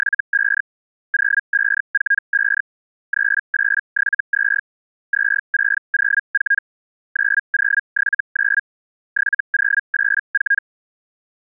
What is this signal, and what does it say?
Hellschreiber (Feld-Hell, 122.5 baud), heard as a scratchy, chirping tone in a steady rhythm, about 1650 Hz. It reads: … 0545 3872 2604 9079 7084